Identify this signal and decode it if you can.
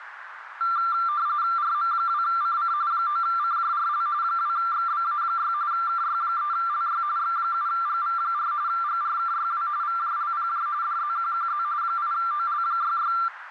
RTTY (45.45 baud, 170 Hz shift), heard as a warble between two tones, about 1270 Hz centre, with radio static and a narrow filter. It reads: RM2CC 9CJRL 2XBA6 KY3LY X7GV4 GRKYW VJLPJ DZQQZ 8OL66